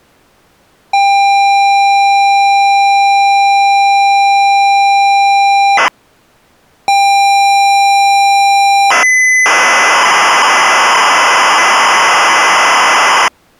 ZX Spectrum tape loading, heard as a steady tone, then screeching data.